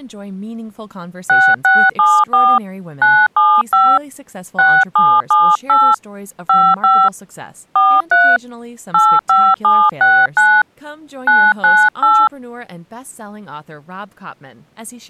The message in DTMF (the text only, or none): 6674 975 6778 55 43 85769 998